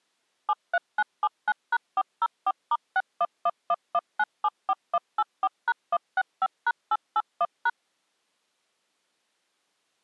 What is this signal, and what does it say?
DTMF, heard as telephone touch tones, dialled by machine, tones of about 50 ms. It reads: 73979#404*61111974184#165#881#